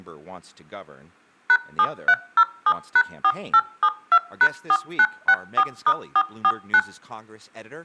DTMF, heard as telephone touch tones, dialled by machine, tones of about 60 ms, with room echo and speech in English. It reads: #7307#4872#4964*449